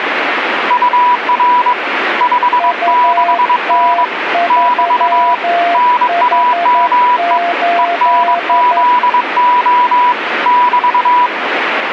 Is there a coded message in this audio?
Yes: Morse code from 0.6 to 11.3 s, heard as two keyed tones, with radio static. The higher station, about 22 wpm, 980 Hz: UR 56N <BT> NAME ENZO <BT>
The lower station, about 11 wpm, 690 Hz: UT3H8